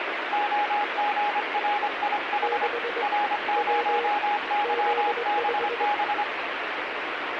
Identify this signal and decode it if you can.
Morse code, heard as two keyed tones, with radio static. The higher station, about 25 wpm, 830 Hz: OGRIH R0YBB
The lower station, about 21 wpm, 470 Hz: 6 W Z5